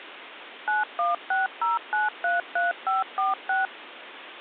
DTMF, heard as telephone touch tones, dialled by machine, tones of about 160 ms, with phone line noise. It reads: 9160933546